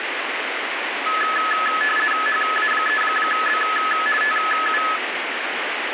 RTTY (50 baud, 450 Hz shift), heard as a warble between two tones, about 1500 Hz centre, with radio static. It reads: HA3B TU